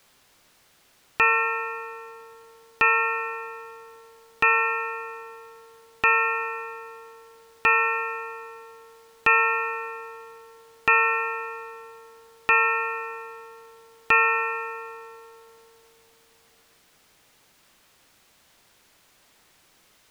Clock strike, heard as a bell. 9. Nine o'clock.